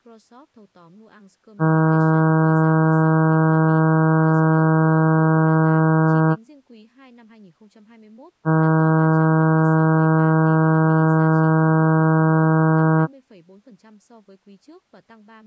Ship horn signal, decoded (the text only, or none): 2 long